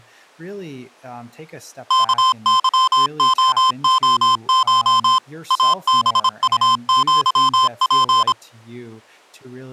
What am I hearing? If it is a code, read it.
Morse code (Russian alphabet), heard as electronic beeps, machine-sent, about 26 wpm, 1040 Hz, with speech in English. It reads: КЫООШ АБУЪП